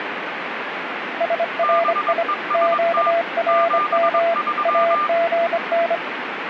Morse code, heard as two keyed tones, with radio static. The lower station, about 25 wpm, 680 Hz: SRI QRM AGN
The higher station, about 22 wpm, 1200 Hz: BEST 73